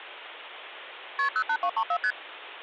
Multi-frequency trunk signalling (R1, as on North American trunks), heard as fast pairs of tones, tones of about 70 ms, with phone line noise. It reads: KP 08234 ST